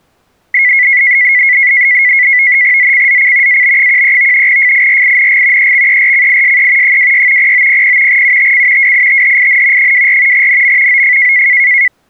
NAVTEX (SITOR-B), 100 baud, 170 Hz shift, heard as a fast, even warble, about 2050 Hz centre. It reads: ZCZC AB13 FIRING EXERCISE 26 0900 UTC WITHIN 24 NM OF